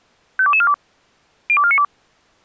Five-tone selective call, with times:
0.4-0.7 52242
1.5-1.8 02492

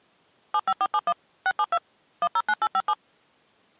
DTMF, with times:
0.5-1.1 75471
1.5-1.8 672
2.2-2.9 109857

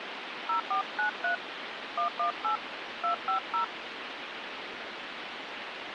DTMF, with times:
0.5-1.3 0493
2.0-2.6 118
3.0-3.6 250

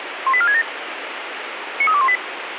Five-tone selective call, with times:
0.3-0.6 18467
1.8-2.2 93218

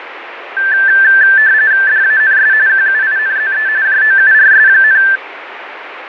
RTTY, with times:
1.9-2.5 DANS
2.7-3.7 QUINZE
3.9-5.0 JOURS,

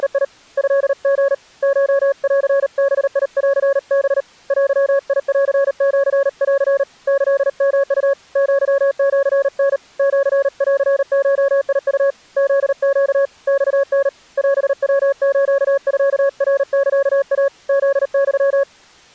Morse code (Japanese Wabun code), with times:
0.0-0.2 …
0.6-1.3 トリ
1.6-4.2 コンバンハ
4.5-6.8 デンシン
7.1-8.1 キヨウ
8.4-9.8 アシタ
10.0-12.1 シンゴウ
12.4-13.3 フネ
13.5-14.1 マタ
14.4-17.5 オヤスミナサイ
17.7-18.6 フユ

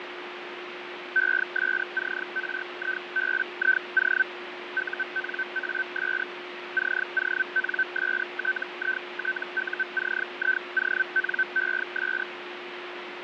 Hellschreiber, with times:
1.2-4.2 ESCRIBIO
4.8-6.2 UNAS
6.8-12.2 CONSTITUCIONES

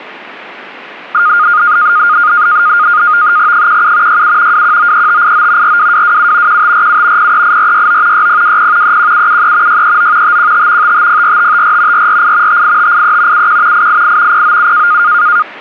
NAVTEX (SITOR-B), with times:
3.5-4.2 17
4.1-4.6 67
4.5-5.8 2193589
5.6-6.6 42227
6.5-7.3 1547
7.2-8.3 038469
8.1-9.0 6020
8.8-9.8 31773
9.7-10.4 639
10.2-10.9 515
10.8-12.1 5504554
11.9-12.6 448
12.5-13.5 58583
13.3-13.9 71
13.7-14.4 888
14.3-15.0 097

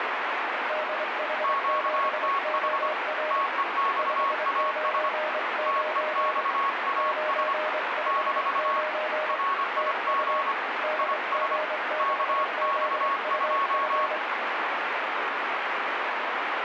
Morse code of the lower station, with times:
0.7-3.4 DH7OR
4.0-6.4 599
7.0-9.4 959
9.8-10.4 TU
10.8-14.2 DG6ZUF

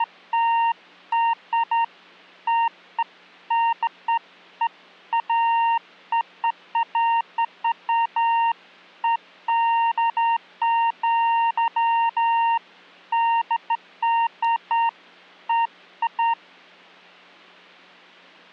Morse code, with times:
none

